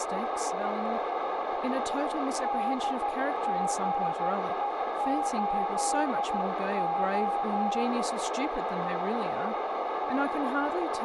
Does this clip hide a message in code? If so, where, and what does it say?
Yes: Morse code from 2.4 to 7.9 s, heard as a keyed tone, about 13 wpm, 810 Hz, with heavy radio static, a narrow filter and speech in English. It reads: DGE8O